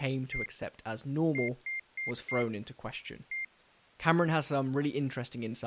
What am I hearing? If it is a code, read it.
Beep code, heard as a piezo beeper, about 2100 Hz, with speech in English. 1-4-1. In Phoenix BIOS tables: address line failure in the first 64 KB of memory.